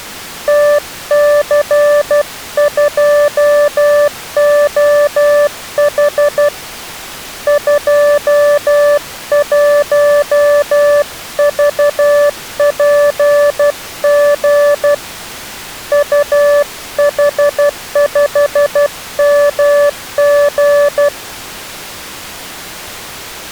Morse code, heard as a keyed tone, hand-sent with a paddle, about 12 wpm, 580 Hz. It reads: TC2OH 21VPG UH5MG